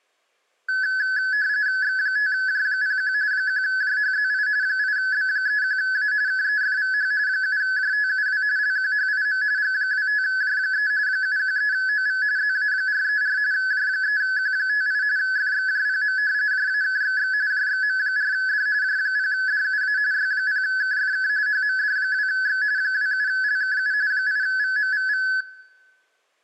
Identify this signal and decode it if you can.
RTTY (45.45 baud, 170 Hz shift), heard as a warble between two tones, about 1600 Hz centre, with room echo. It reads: X5J01 1JHZI 8B31A KEFVH 7JTUW LQHIM G25J3 713OV ZA434 J3Q58 FXJPM JAKXX JXM4D J0DUA Y0KFK HMD2X 27LKU 8VMVV